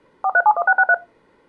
DTMF, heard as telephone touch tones, dialled by machine, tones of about 60 ms. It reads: 4371663